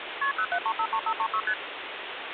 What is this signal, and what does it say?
Multi-frequency trunk signalling (R1, as on North American trunks), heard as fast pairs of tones, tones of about 70 ms, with phone line noise. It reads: KP 07353536 ST